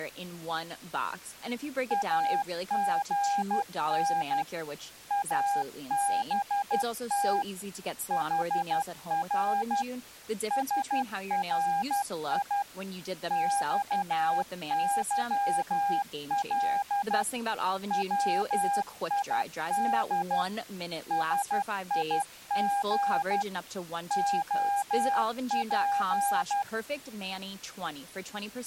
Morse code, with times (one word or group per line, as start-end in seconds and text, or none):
1.9-4.4 AGN
5.1-7.4 ABT
8.1-9.8 HR
10.5-12.6 SRI
13.3-17.2 XYL
17.9-20.4 WID
21.1-23.4 SIG
24.1-26.6 OP